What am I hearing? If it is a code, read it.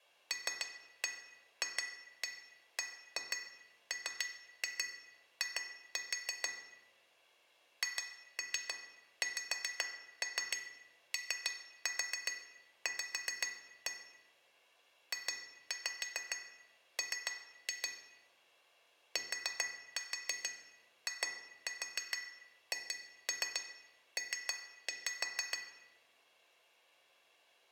Tap code, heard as taps on glass, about 6 knocks a second, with room echo. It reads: LFBMI HXOV JM TIHP